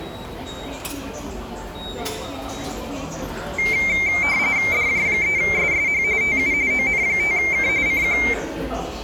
RTTY (45.45 baud, 170 Hz shift), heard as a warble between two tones, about 2200 Hz centre, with the noise of a subway station. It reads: DJ3SSH TU ON5K CQ